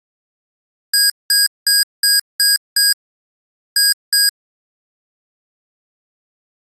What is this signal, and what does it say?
Beep code, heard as beeps from a small speaker, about 1650 Hz. 6-2.